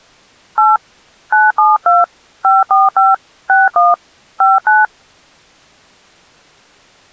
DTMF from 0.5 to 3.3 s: 8 972 545

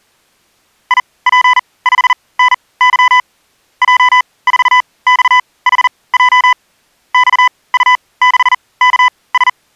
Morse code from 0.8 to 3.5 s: IP5NY

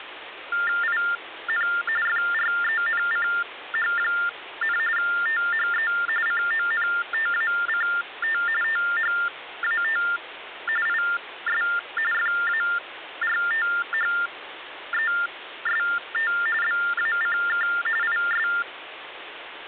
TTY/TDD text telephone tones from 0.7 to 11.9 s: IN FRENCH, THE CONTACT THAT IS

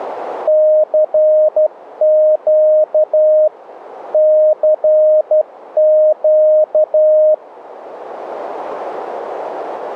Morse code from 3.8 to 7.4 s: CQ

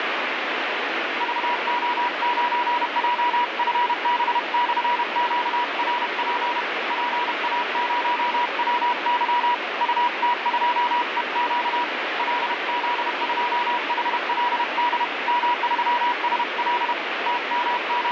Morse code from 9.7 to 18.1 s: UT2EQ LZ2HLD M3SL …

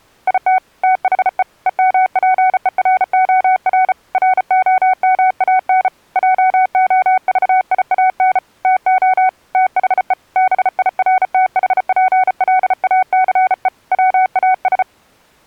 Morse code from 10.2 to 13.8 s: BIRTHPLACE

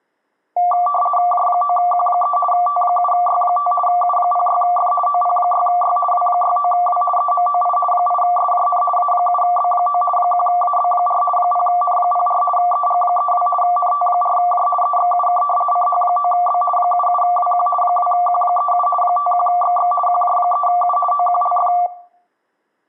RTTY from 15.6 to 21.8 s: CH9B 77WQ 2Q37 51XX QJ3U OQLF

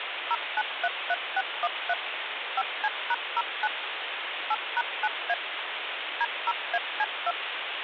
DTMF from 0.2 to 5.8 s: 0933613 5C#09 8#9A

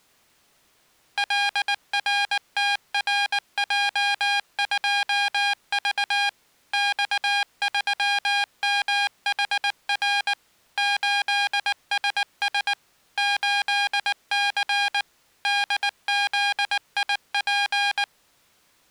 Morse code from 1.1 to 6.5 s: LRTRJ2V

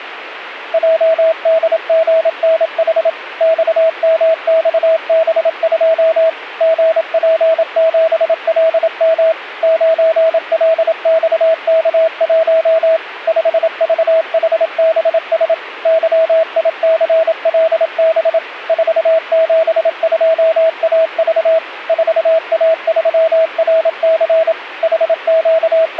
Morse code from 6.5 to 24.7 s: GP7LM 9LXK1 5VHBS YICLB 472AV 4A3RC

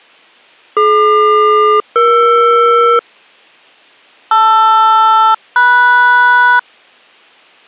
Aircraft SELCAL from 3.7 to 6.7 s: LR-MS

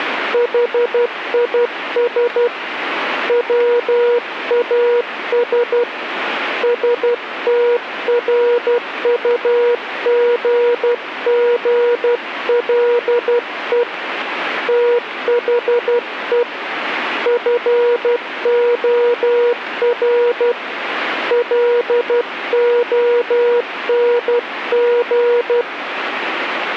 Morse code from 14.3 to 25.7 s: THE FOR LONG

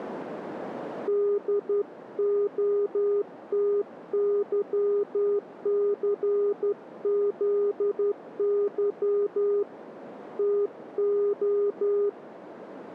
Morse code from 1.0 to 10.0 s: DOTYCZY

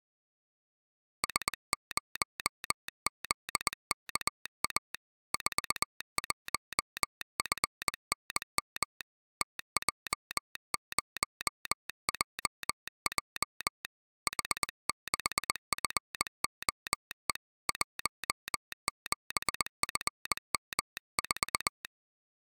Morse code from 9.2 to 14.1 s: TJ0JJ

